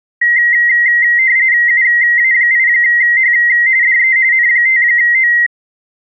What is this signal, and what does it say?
RTTY (45.45 baud, 170 Hz shift), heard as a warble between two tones, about 2000 Hz centre. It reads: UA8H DE N5O